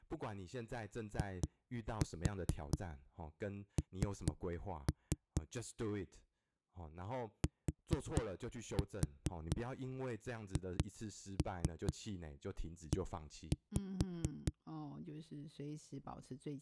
Tap code, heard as knocks on a wall, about 4 knocks a second, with speech in Chinese. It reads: IN THE